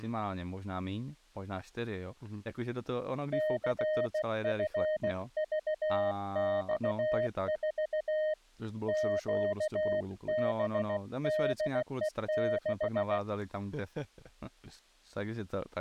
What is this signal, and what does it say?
Morse code, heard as a keyed tone, hand-sent with a bug key, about 16 wpm, 620 Hz, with speech in Czech. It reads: CFVX4 QBDE6